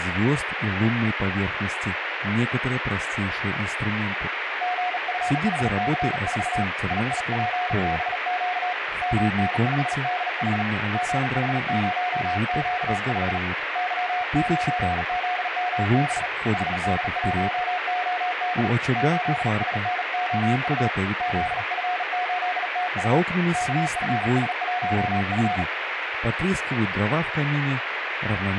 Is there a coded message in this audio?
Yes: Morse code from 4.6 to 25.7 s, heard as a keyed tone, hand-sent with a bug key, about 38 wpm, 720 Hz, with radio static. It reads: GFHC4 IIPBQ MN5DH GH0Q5 Y9ZMB HD1OD 8SNOU ZF8TU KFS1F